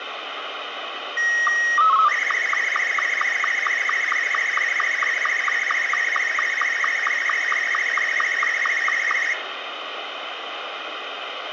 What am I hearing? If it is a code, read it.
SSTV (slow-scan television), Martin M2, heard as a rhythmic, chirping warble, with radio static and room echo.